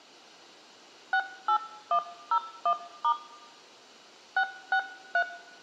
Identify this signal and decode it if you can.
DTMF, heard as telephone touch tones, dialled by hand, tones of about 80 ms, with room echo. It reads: 68101* 663